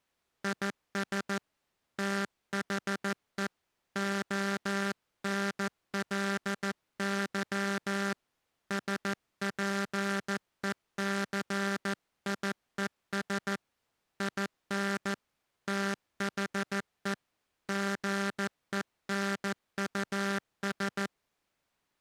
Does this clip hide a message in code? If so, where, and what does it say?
Yes: Morse code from 0.4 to 21.1 s, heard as a buzzer, hand-sent with a paddle, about 14 wpm. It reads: IS THE ONLY SPECIES IN THE GENUS